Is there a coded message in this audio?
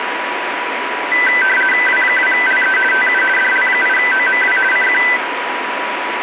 Yes: RTTY (50 baud, 450 Hz shift) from 1.1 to 5.2 s, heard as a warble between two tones, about 1750 Hz centre, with radio static and a steady whistle near 980 Hz. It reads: W2LE TU DL8OMW CQ